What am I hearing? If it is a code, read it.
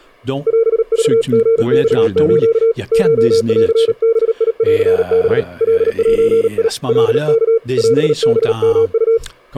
Morse code (Japanese Wabun code), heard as a keyed tone, hand-sent with a paddle, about 38 wpm, 460 Hz, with speech in French. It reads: オクリマス コンバンハ カゼ カワ オハヨウ